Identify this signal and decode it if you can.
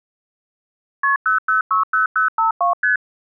Multi-frequency trunk signalling (R1, as on North American trunks), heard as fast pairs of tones, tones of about 130 ms. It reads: KP 0060052 ST